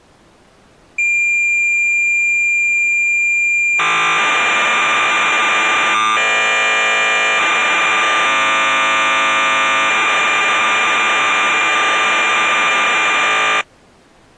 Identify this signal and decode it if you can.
Cassette data (Kansas City type), 1200 baud, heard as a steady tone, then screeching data.